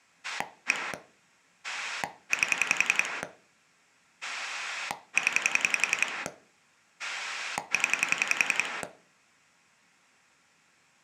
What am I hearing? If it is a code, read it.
Pulse dialling, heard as a rotary dial, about 11 pulses a second. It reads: 1 8 0 0